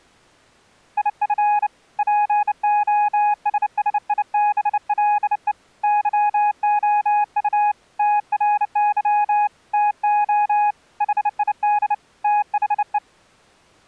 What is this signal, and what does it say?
Morse code, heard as a keyed tone, hand-sent with a bug key, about 29 wpm, 830 Hz. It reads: IF POSSIBLE YOU TRY TO HID THE